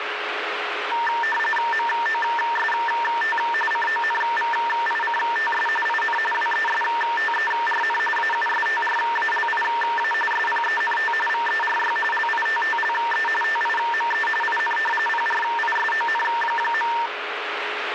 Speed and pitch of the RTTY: 45.45 baud, 850 Hz shift, 1360 Hz centre

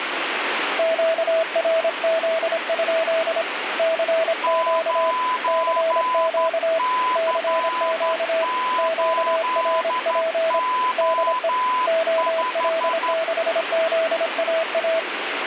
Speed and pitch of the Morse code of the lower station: 26 wpm, 650 Hz

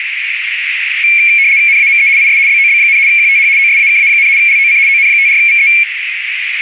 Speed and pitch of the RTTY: 75 baud, 170 Hz shift, 2300 Hz centre

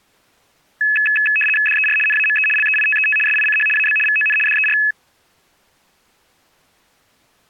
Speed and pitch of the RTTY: 75 baud, 850 Hz shift, 2150 Hz centre

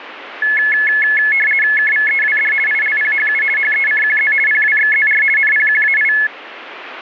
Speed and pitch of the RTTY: 50 baud, 450 Hz shift, 1950 Hz centre

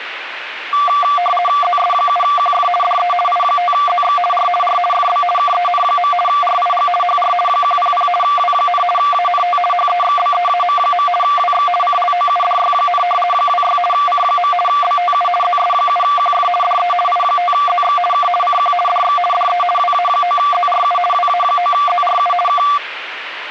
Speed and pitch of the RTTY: 50 baud, 450 Hz shift, 930 Hz centre

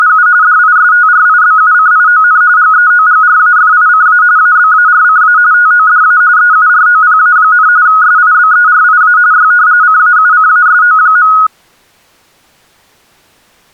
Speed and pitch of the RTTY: 45.45 baud, 170 Hz shift, 1360 Hz centre

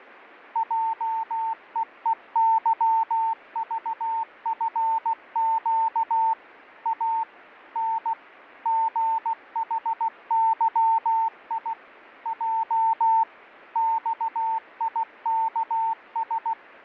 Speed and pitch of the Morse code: 16 wpm, 900 Hz

